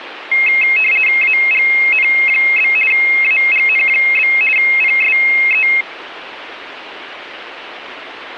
RTTY (50 baud, 450 Hz shift), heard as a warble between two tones, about 2350 Hz centre, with radio static. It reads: AGN? AGN? PSE